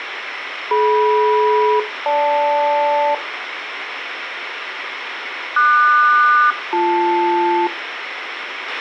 Aircraft SELCAL, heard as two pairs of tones, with radio hiss, a squelch burst at the end and room echo. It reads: DM-GL QS-BL